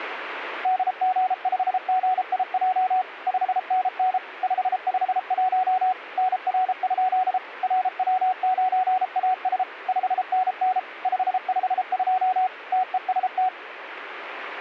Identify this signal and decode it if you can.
Morse code, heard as a keyed tone, machine-sent, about 33 wpm, 740 Hz. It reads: DG5GIJ 5NN 551 NR? RW9AS 5NN 552 TEST